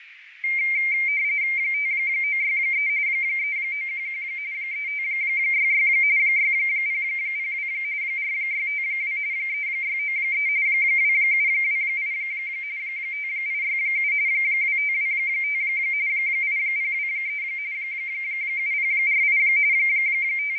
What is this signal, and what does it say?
RTTY (45.45 baud, 170 Hz shift), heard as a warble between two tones, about 2200 Hz centre, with radio static, fading and a narrow filter. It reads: 5963 3911 3566 6002 4652 3693 2728 5867 2525 8023 7048 …